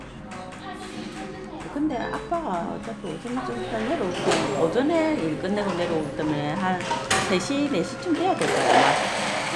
The noise of a crowd indoors. There is no code.